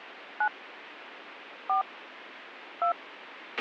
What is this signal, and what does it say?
DTMF, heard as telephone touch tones, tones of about 100 ms, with radio hiss and a squelch burst at the end. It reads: 9 4 2